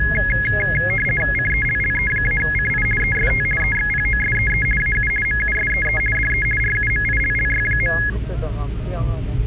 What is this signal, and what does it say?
RTTY (50 baud, 450 Hz shift), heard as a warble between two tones, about 1900 Hz centre, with the noise inside a car. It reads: CELLE-CI EST EXPOSEE AU MUSEE DE RUMILLY.